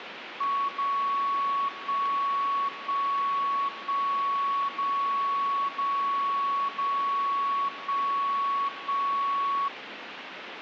Radio time signal (DCF77), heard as a tone whose level steps once a second, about 1120 Hz, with radio static. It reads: 0 1 1 1 0 0 0 1 1